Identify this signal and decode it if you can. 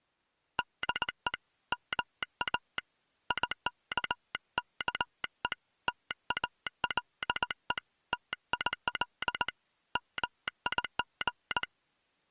Morse code, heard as a telegraph sounder, hand-sent with a straight key, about 19 wpm. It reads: DE MA IKKE TALE TIL MIG